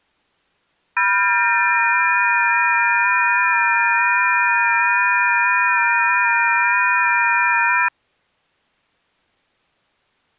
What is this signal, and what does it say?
FT8 (several signals at once), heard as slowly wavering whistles, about 6.25 baud.